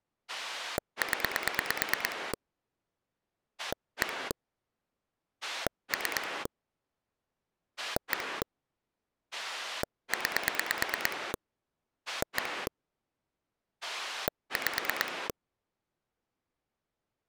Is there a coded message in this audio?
Yes: pulse dialling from 0.3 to 15.3 s, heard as a rotary dial, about 9 pulses a second. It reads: 0 1 3 1 9 1 5